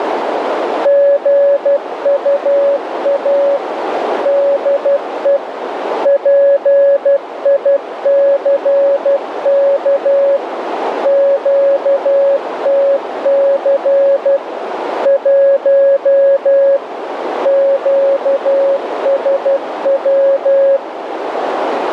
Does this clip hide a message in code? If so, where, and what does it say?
Yes: Morse code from 0.8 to 20.8 s, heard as a keyed tone, machine-sent, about 12 wpm, 560 Hz, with radio static and a narrow filter. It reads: GUA DE PICK QTC 1 QSW